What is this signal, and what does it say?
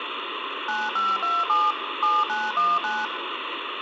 DTMF, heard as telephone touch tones, dialled by machine, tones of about 210 ms, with phone line noise. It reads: 9527 7919